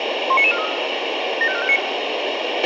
Five-tone selective call (ZVEI), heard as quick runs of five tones, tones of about 70 ms, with radio hiss and a squelch burst at the end. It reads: 19943 75459